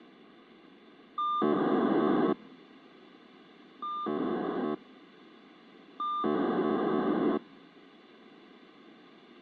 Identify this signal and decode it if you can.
POCSAG pager data (2400 baud), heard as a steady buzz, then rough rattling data, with radio hiss.